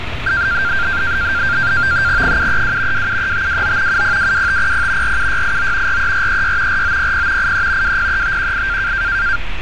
NAVTEX (SITOR-B), 100 baud, 170 Hz shift, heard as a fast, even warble, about 1490 Hz centre, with radio static and street noise. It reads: 732 273529 7022500 47689 43436 4900 83 203518